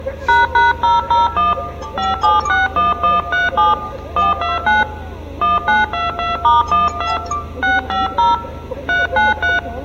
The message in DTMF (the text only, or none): ##001 5761137 129 1922*12 650 393